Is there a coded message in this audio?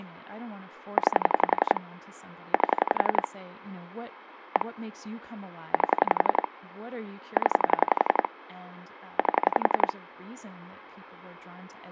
Yes: pulse dialling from 1.0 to 9.9 s, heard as clicks on a phone line, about 11 pulses a second, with speech in English. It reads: 9 8 1 8 0 8